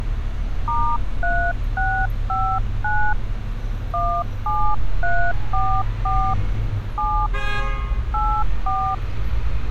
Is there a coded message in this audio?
Yes: DTMF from 0.7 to 8.9 s, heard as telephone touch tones, dialled by hand, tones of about 290 ms, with street noise. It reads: *3659 17344 7 84